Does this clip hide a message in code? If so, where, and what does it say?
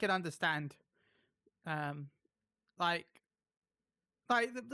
No, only speech in English.